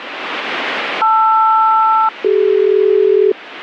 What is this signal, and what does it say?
Aircraft SELCAL, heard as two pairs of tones, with radio static. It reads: LR-CD